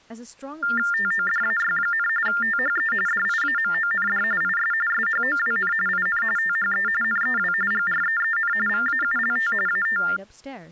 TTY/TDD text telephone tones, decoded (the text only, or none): TODAY, THE DIAMOND IS SHOWN IN THE NEW GREEN VAULT AT